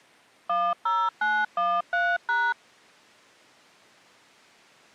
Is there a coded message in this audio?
Yes: DTMF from 0.5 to 2.5 s, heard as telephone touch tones, dialled by machine, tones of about 240 ms. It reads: 10913#